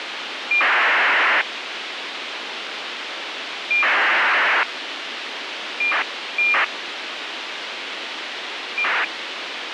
ACARS aircraft data, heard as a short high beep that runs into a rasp, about 2400 baud, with radio hiss.